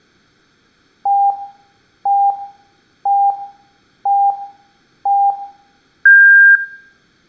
Radio time signal (five pips and a higher one, as on Chinese radio), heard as pips.